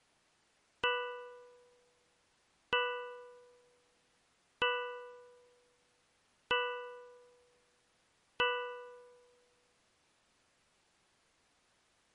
Clock strike, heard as a bell. 5. Five o'clock.